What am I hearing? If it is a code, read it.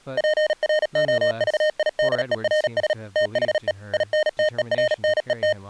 Morse code, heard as electronic beeps, machine-sent, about 37 wpm, 610 Hz, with speech in English. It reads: PROVIDERS THE INTERNET